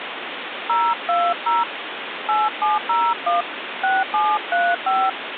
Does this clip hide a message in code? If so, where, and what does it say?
Yes: DTMF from 0.7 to 5.1 s, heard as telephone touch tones, dialled by hand, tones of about 190 ms, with phone line noise. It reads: 020 8701 6735